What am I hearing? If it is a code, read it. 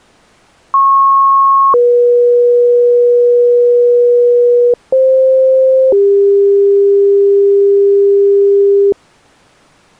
Two-tone page, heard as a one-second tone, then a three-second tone, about 1090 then 480 Hz, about 520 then 400 Hz.